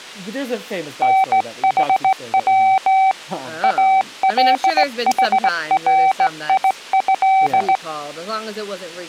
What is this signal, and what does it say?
Morse code (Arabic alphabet), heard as a keyed tone, hand-sent with a straight key, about 18 wpm, 770 Hz, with speech in English. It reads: نحو الحريه